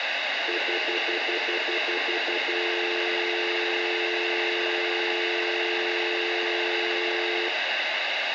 Telephone call progress tone (North American plan), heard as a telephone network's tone, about 350, 440 Hz, 0.1 s on and 0.1 s off, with phone line noise and room echo. Stutter dial tone.